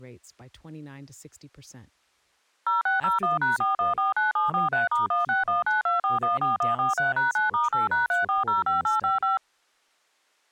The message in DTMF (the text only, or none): 0601#4149743*16192414143#9*8#3405855